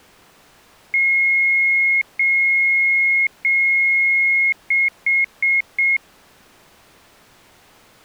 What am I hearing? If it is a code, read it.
Beep code, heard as beeps, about 2150 Hz. 3 long, 4 short.